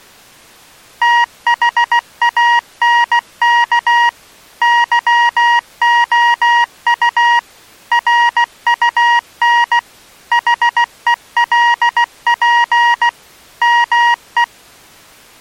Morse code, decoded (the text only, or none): THANK YOU RUN HELP ME